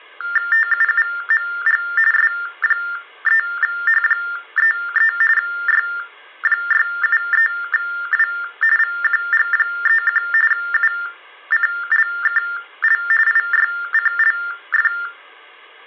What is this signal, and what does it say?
TTY/TDD text telephone tones (45.45 baud Baudot), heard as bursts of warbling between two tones, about 400 Hz shift, 1600 Hz centre. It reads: TUUMG S3H33 Y673W VQG31 UCLKL IYCLF